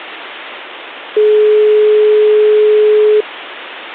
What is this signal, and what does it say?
Telephone call progress tone (425 Hz plan, as in most of Europe), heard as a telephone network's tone, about 420 Hz. Dial tone.